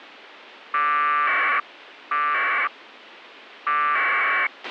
Packet radio (AX.25, as in APRS), 1200 baud, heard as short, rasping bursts, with a squelch burst at the end.